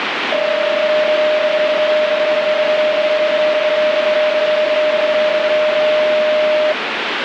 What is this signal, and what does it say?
PSK31 (31.25 baud), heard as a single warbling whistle, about 610 Hz, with radio static.